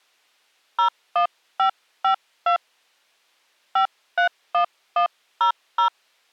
DTMF, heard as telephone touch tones, dialled by hand, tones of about 100 ms. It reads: 01552 531100